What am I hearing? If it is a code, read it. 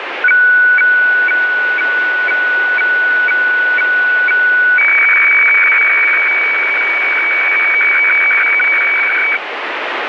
Weather fax (radiofax), 120 lines a minute, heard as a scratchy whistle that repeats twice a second, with radio static.